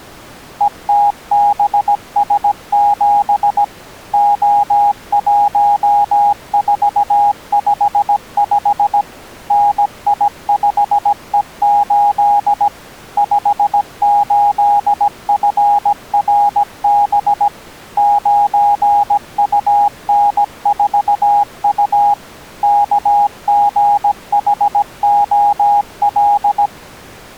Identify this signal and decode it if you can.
Morse code, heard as a keyed tone, machine-sent, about 17 wpm, 820 Hz. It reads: ETBS7 O1455 NI5E8 58FRB 9UN4U KGHOL